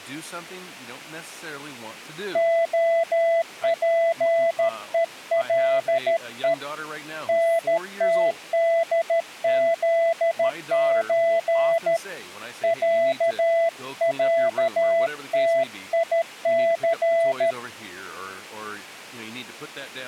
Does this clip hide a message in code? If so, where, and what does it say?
Yes: Morse code (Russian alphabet) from 2.3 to 17.6 s, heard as a keyed tone, hand-sent with a paddle, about 13 wpm, 670 Hz, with speech in English. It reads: ОПЕЛЕ НТДЗЧ ЯЯТИЦ